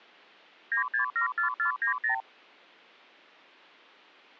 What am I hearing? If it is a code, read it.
Multi-frequency trunk signalling (R2, with the far end's replies), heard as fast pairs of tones, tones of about 110 ms. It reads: 9674490